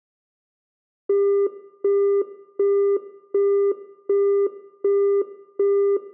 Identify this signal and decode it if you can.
Telephone call progress tone (as in the UK, Australia and similar networks), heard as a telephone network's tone, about 400 Hz, 0.375 s on and 0.375 s off, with room echo. Busy tone.